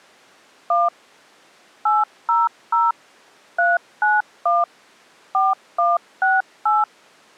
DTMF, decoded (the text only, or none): 1 800 391 4168